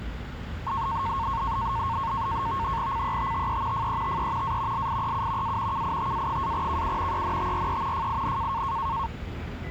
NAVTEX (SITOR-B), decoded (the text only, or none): CETTE FETE A LIEU A KITA-KU ENTRE FIN